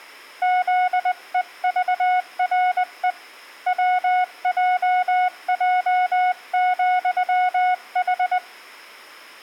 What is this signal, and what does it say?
Morse code, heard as a keyed tone, hand-sent with a paddle, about 20 wpm, 730 Hz, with room echo. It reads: ZEVRE WJJ,H